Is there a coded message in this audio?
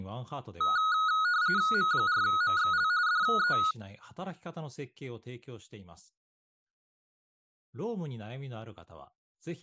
Yes: RTTY (45.45 baud, 170 Hz shift) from 0.6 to 3.7 s, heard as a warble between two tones, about 1360 Hz centre, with speech in Japanese. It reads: M4MXL DE